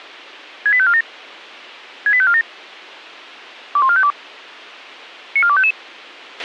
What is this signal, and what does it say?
Five-tone selective call (ZVEI), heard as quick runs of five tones, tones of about 70 ms, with a squelch burst at the end. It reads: 68547 68547 21452 94255